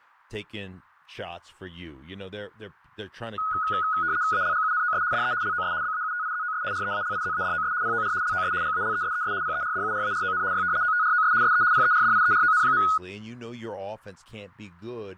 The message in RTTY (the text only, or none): ALGUNOS DE LOS BAUTIZOS REALIZADOS POR LOS GALESES PERDURARON Y OTROS SE PERDIERON.